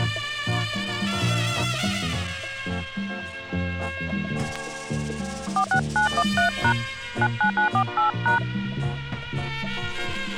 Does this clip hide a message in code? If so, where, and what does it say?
Yes: DTMF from 5.6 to 8.4 s, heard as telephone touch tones, dialled by hand, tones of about 90 ms. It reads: 46913# 99948#